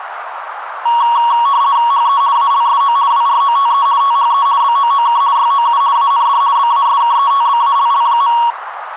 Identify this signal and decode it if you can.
RTTY (50 baud, 170 Hz shift), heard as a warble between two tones, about 1030 Hz centre, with radio static and a narrow filter. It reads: HE ALSO WROTE THE BOOK YOU AND BASKETBALL.